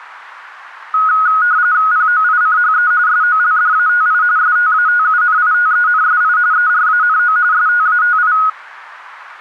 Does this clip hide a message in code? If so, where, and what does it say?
Yes: RTTY (45.45 baud, 170 Hz shift) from 0.9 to 8.5 s, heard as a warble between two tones, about 1360 Hz centre. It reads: POICHE SOLDATI STATUNITENSI ERANO STATI